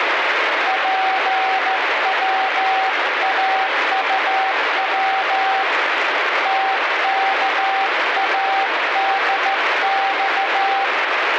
Morse code, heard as a keyed tone, hand-sent with a straight key, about 14 wpm, 770 Hz, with heavy radio static. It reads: PWAUW TKADX